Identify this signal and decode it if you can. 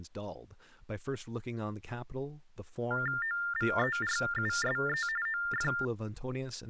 TTY/TDD text telephone tones (45.45 baud Baudot), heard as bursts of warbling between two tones, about 400 Hz shift, 1600 Hz centre, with speech in English. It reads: OVERUSE OF